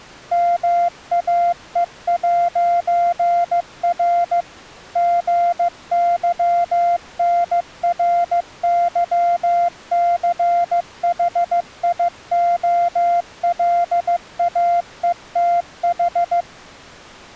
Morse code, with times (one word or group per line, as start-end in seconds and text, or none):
0.3-4.4 MAE'R
5.0-16.4 GYNRYCHIOLAETH